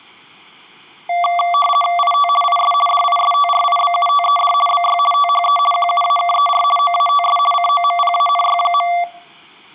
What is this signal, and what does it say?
RTTY (50 baud, 450 Hz shift), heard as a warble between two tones, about 920 Hz centre. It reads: IT IS DISTRIBUTED BY THE QUAKER OATS COMPANY.